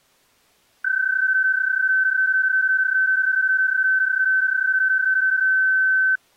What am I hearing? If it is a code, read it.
PSK31 (31.25 baud), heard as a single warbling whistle, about 1550 Hz.